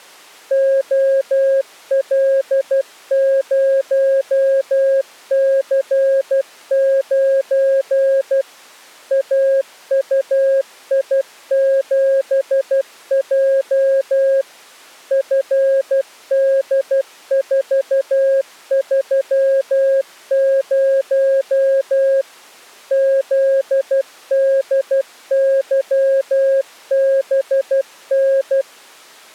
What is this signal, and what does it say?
Morse code, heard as a keyed tone, machine-sent, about 12 wpm, 540 Hz. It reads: OL0C9 AUI7J FD430 ZDYBN